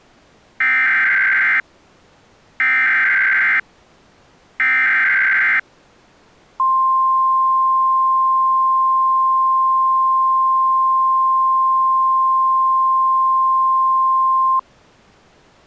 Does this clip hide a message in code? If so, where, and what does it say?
Yes: Emergency Alert System (SAME) tones (header bursts, then the 1050 Hz attention tone) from 0.6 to 14.6 s, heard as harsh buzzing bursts, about 520.83 baud.